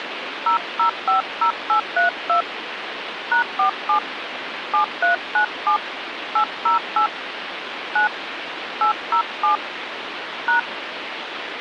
DTMF, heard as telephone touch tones, dialled by hand, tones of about 110 ms, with phone line noise. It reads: 0050832 #47 7397 808 9 807 #